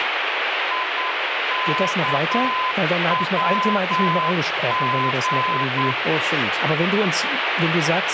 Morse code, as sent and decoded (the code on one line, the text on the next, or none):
.. -.- .-- --.
IKWG